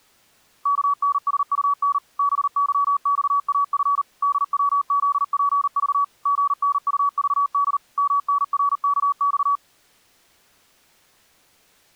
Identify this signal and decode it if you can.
Morse code, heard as a keyed tone, machine-sent, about 39 wpm, 1140 Hz. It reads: KNSUN BYXAF DWZPV GNUVD MNRKX